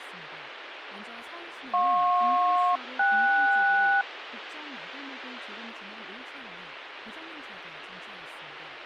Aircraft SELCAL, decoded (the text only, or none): JP-KS